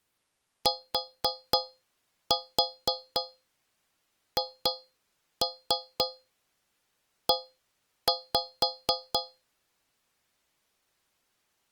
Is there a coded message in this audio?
Yes: tap code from 0.7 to 9.4 s, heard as taps on a metal pipe, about 4 knocks a second. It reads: THE